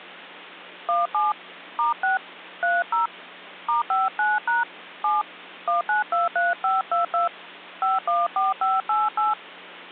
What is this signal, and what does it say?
DTMF, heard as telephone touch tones, dialled by hand, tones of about 160 ms, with hum. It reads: 17 *6 30 *59# 7 1923522 514588